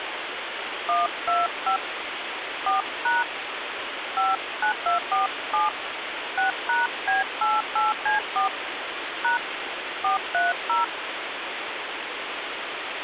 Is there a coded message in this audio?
Yes: DTMF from 0.9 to 10.8 s, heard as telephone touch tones, dialled by hand, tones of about 150 ms, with phone line noise. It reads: 125 4# 59247 6#B88C4 # 430